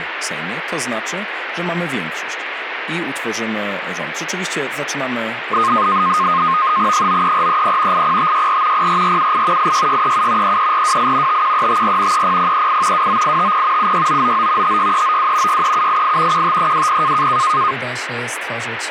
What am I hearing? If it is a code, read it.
NAVTEX (SITOR-B), 100 baud, 170 Hz shift, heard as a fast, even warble, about 1150 Hz centre, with radio static. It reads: 93430 80564 04478 86637 33428 51354 30038 29850 76999 56392 63788 15320